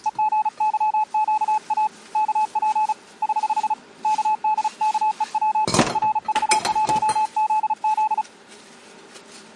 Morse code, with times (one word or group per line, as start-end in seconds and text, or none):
0.1-1.9 EGYQA
2.2-2.9 KP
3.2-3.7 <HH>
4.0-5.6 KDKEW
6.0-8.2 RV1ZZ